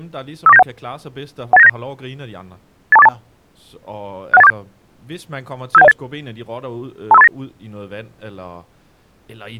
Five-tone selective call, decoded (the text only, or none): 54971 18979 82482 61847 57108 25389